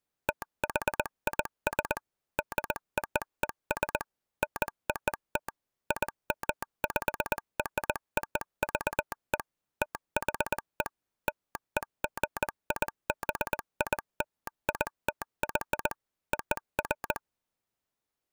Morse code (American railroad code), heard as a telegraph sounder, machine-sent. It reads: THIS DOES NOT IMPROVE THE LEGIBILITY OF